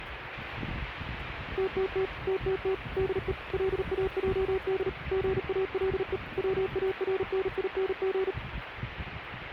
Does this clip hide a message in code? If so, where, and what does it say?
Yes: Morse code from 1.5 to 8.4 s, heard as a keyed tone, machine-sent, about 38 wpm, 380 Hz, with radio static and street noise. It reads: TTT TTT DE LAJD GALE WARNING